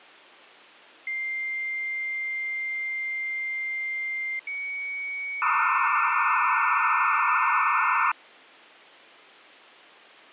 Dial-up modem handshake (low-speed, two carriers), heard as two whistles, then hiss, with phone line noise.